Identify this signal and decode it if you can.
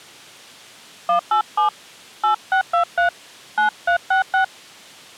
DTMF, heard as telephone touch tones, dialled by hand, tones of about 100 ms. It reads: 187 8623 9366